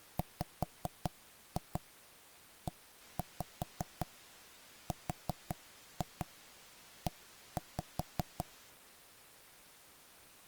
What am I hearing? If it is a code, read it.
Tap code, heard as knocks on wood, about 5 knocks a second. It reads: WERE